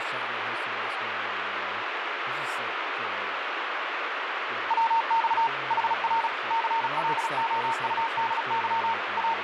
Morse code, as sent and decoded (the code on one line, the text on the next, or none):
.-- -..- / .... .-. / -.-. .-.. --- ..- -.. -.-- / …
WX HR CLOUDY …